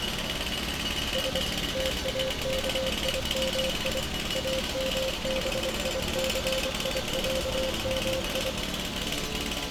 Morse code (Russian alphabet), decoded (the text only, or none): С ТАКИМИ АМБИЦИЯМИ